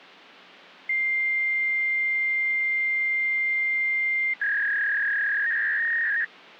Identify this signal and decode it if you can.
Fax machine handshake, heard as a long tone and a warble.